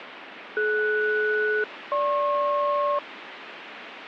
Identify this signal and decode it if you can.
Aircraft SELCAL, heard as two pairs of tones, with radio static. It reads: DS-GP